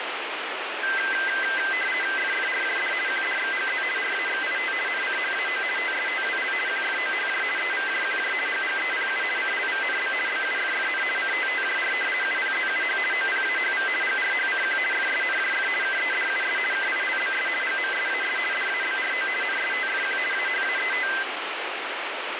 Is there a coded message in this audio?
Yes: RTTY (50 baud, 450 Hz shift) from 0.8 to 21.2 s, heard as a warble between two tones, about 1800 Hz centre, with radio static. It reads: FFRJD QDXGZ RAXIT NCHAO TSTWL QFOHJ EVJQJ GGEPU CLVNB BUFFN CTTJR UPZUH OPAHV GRHCQ FSNJF KEDUS KILBS GMSAS DABRO NSTFQ AHAET